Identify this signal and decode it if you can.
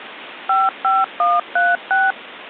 DTMF, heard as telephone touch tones, dialled by machine, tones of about 200 ms, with phone line noise. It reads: 55136